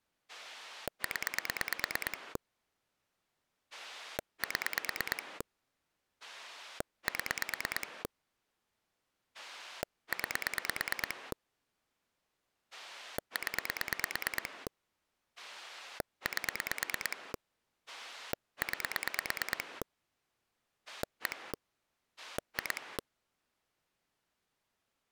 Pulse dialling, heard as a rotary dial, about 9 pulses a second. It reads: 0 7 7 9 0 8 9 1 2